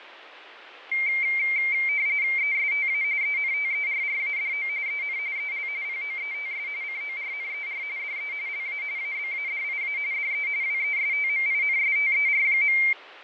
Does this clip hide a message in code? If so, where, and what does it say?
Yes: RTTY (45.45 baud, 170 Hz shift) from 0.9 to 12.9 s, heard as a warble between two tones, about 2200 Hz centre, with radio static and fading. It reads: ESTA ENTERRADO EN EL POETS CORNER DE LA ABADIA DE WESTMINSTER.